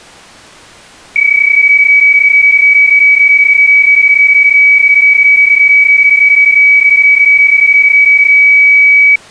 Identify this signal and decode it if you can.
PSK31 (31.25 baud), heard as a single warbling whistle, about 2300 Hz.